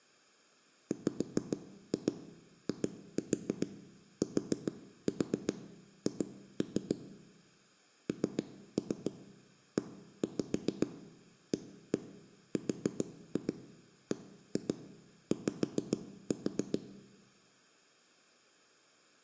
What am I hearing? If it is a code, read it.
Tap code, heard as knocks on wood, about 7 knocks a second, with room echo. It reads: WITH NEARBY